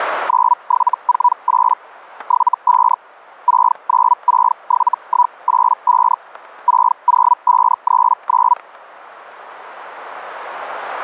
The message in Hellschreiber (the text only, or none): 9748 75 6967185 60539